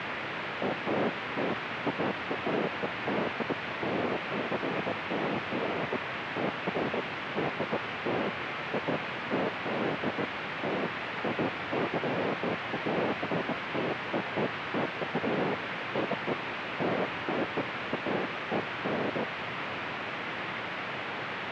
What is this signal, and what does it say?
Bursts of noise, with radio static. There is no code.